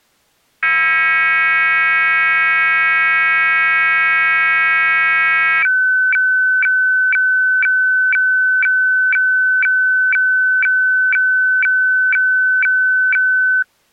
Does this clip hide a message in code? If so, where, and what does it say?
Yes: weather fax (radiofax), 120 lines a minute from 0.6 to 13.6 s, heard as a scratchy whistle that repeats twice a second.